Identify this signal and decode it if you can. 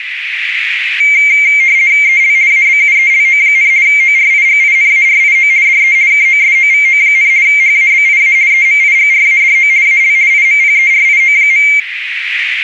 RTTY (50 baud, 170 Hz shift), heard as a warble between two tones, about 2200 Hz centre, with radio static and a narrow filter. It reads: EL ABUELO, ORIGINARIO DE KOSOVO, HABIA EMIGRADO AL IMPERIO.